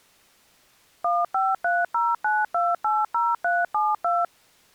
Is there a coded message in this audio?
Yes: DTMF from 1.0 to 4.2 s, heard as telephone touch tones, dialled by machine, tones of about 200 ms. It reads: 15309280372